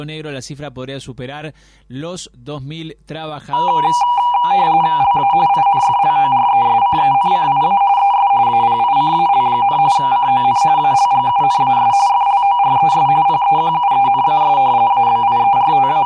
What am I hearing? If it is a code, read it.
RTTY (45.45 baud, 170 Hz shift), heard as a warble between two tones, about 880 Hz centre, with room echo. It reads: LA INFLORESCENCIA ES APICAL, CON ALGUNAS FLORES PEQUENAS …